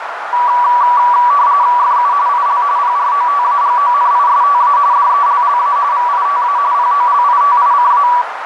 RTTY (45.45 baud, 170 Hz shift), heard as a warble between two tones, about 1060 Hz centre, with radio static and a narrow filter. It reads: FU IL PROTAGONISTA DELLA VITA POLITICA